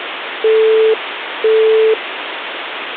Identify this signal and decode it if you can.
Telephone call progress tone (single-tone plan, as in Europe, Japan and elsewhere), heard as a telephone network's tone, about 440 Hz, 0.5 s on and 0.5 s off, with phone line noise. Busy tone.